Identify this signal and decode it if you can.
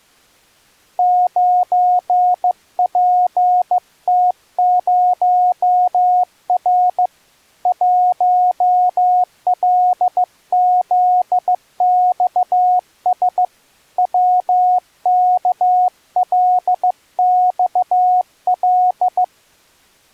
Morse code, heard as a keyed tone, hand-sent with a bug key, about 15 wpm, 730 Hz. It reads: 9PT0R 1LZXS WKLXL